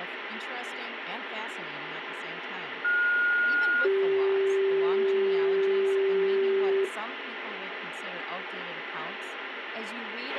Two-tone page, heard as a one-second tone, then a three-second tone, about 1430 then 390 Hz, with radio hiss and a squelch burst at the end.